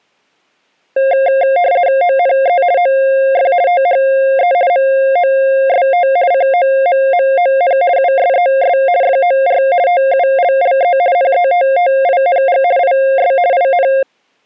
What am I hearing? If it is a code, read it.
RTTY (50 baud, 170 Hz shift), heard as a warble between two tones, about 620 Hz centre. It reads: ONE OF THE MOST COMMON USES FOR TULLE NETTING IS IN